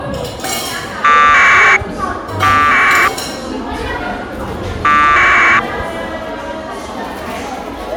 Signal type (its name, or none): packet radio (AX.25, as in APRS)